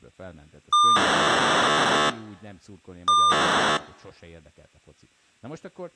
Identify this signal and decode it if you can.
POCSAG pager data (2400 baud), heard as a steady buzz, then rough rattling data, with speech in Hungarian.